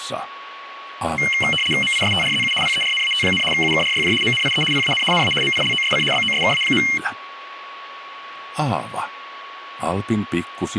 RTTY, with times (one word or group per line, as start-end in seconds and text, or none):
1.8-2.5 MISTRZU
2.6-3.4 PERNAT,
3.5-4.1 UKRYJ
4.2-4.6 MNIE
4.7-5.0 PAN
5.1-5.3 NA
5.4-6.0 MILOSC
6.1-6.8 BOSKA.